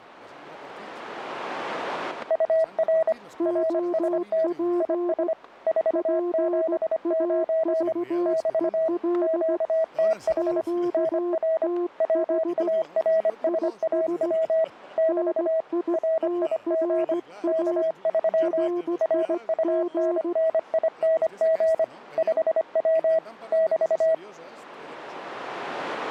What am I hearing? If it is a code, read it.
Morse code, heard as two keyed tones, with static crashes. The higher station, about 25 wpm, 650 Hz: UR RST IS 479 <BT> QTH NR WARSAW <BT> RIG K3 RUNNING 5W <BT>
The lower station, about 16 wpm, 350 Hz: OP PAVEL QTH IS NITRA RIG